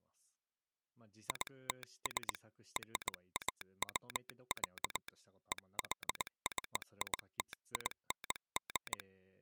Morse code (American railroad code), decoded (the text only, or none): ITS RAW, EXCITING